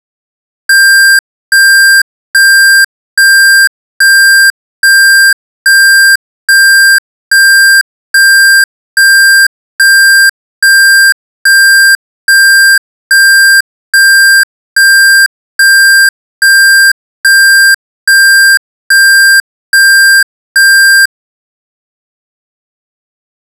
Evenly repeated beeps. There is no code.